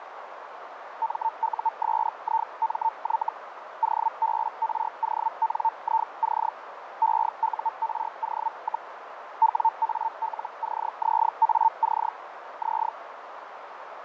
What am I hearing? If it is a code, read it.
Hellschreiber (Feld-Hell, 122.5 baud), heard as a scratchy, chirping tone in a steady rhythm, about 900 Hz, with radio static, fading and a narrow filter. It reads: MUSIMY OBRONIC EURO, WALCZAC Z